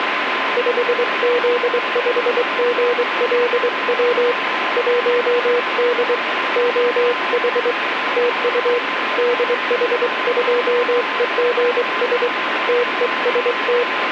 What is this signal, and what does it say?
Morse code, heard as a keyed tone, hand-sent with a straight key, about 23 wpm, 480 Hz, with radio static and a steady whistle near 1030 Hz. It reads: 5Z5GLW 1D OH TU DH2EGS TEST